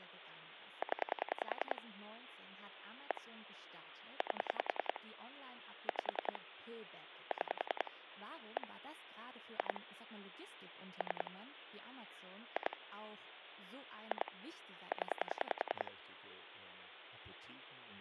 Pulse dialling, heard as clicks on a phone line, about 10 pulses a second, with phone line noise and speech in German. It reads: 0 1 8 5 6 1 2 3 2 2 0